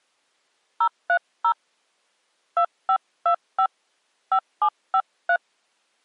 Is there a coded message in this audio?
Yes: DTMF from 0.8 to 5.4 s, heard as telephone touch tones, dialled by hand, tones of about 80 ms. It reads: 030 2525 5753